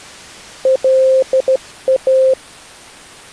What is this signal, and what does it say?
Morse code, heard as a keyed tone, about 14 wpm, 520 Hz. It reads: LA